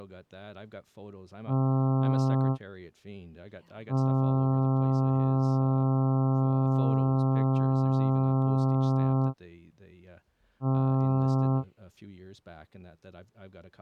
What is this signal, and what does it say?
Ship horn signal, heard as a ship's horn, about 130 Hz, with speech in English. 1 short, 1 long, 1 short. At sea: a vessel at anchor warns of its position.